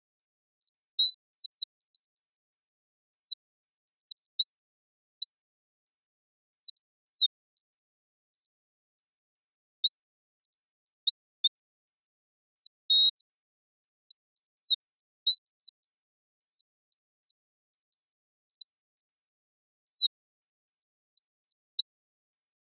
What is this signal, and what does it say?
Bird-like chirps. There is no code.